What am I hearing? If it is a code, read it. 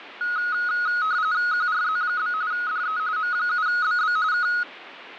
RTTY (45.45 baud, 170 Hz shift), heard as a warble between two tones, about 1360 Hz centre, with radio static. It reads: QRZ? DE M7BB K